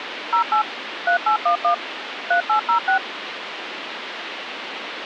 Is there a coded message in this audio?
Yes: DTMF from 0.3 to 3.0 s, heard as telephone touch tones, dialled by machine, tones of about 100 ms, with phone line noise. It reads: 08 3811 3806